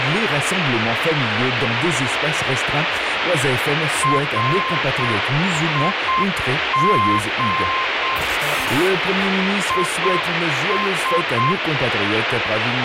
Morse code, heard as a keyed tone, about 7 wpm, 1050 Hz, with heavy radio static. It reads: RIG IS